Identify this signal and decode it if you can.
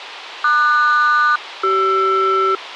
Aircraft SELCAL, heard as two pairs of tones. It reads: QS-CR